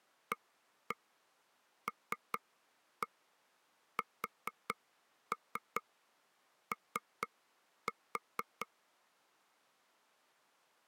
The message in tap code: ALSO

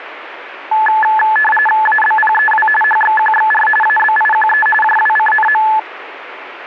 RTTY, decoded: ABPEW HXQXR ABIQE JWCNM

